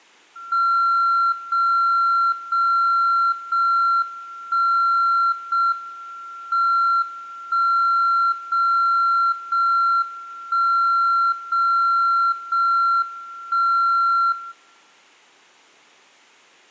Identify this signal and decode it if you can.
Radio time signal (JJY), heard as a tone whose level steps once a second, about 1370 Hz. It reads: 0 0 0 1 0 M 1 0 0 1 0 0 1 0